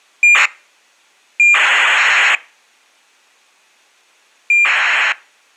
ACARS aircraft data, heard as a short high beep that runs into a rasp, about 2400 baud.